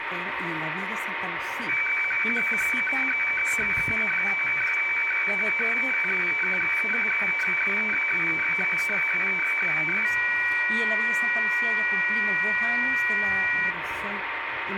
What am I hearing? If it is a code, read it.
Weather fax (radiofax), 120 lines a minute, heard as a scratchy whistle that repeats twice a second, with radio static.